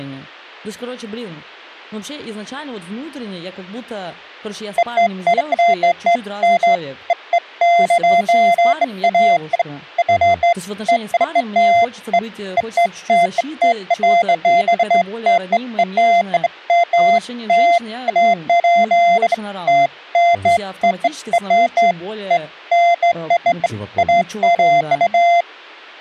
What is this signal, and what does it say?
Beeps of irregular length, with speech in Russian. There is no code.